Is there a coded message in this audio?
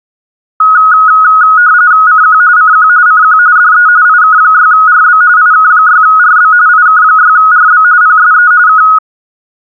Yes: RTTY (45.45 baud, 170 Hz shift) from 0.6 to 9.0 s, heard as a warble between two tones, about 1360 Hz centre. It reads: CQ CQ CQ DE IK6RB IK6RB IK6RB PSE K